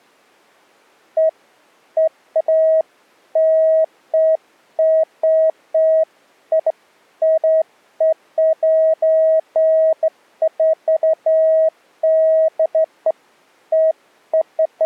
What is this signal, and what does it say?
Beeps of irregular length. There is no code.